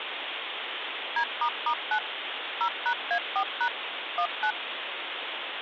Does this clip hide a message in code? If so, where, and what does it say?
Yes: DTMF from 1.2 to 4.5 s, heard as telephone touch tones, dialled by machine, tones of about 80 ms, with phone line noise. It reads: D**9 0#A4# 19